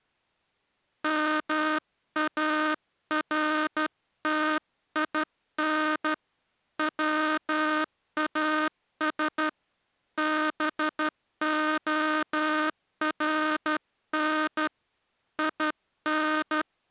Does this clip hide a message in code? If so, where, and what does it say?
Yes: Morse code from 1.0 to 16.7 s, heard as a buzzer, hand-sent with a straight key, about 12 wpm. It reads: MARTIN WAS BORN IN